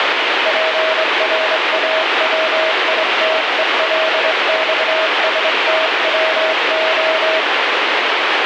Morse code (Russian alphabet), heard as a keyed tone, hand-sent with a straight key, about 24 wpm, 640 Hz, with heavy radio static. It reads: ПРАВИТЕЛЬСТВО